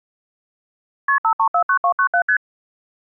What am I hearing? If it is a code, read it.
Multi-frequency trunk signalling (R1, as on North American trunks), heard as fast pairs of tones, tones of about 80 ms. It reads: KP 5349297 ST